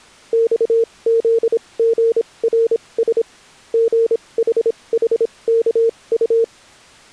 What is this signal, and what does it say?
Morse code, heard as a keyed tone, machine-sent, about 26 wpm, spaced as for 21 wpm, 460 Hz. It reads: XZGRS GHHKU